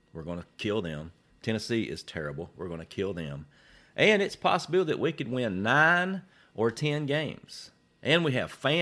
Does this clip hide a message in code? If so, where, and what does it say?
No, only speech in English.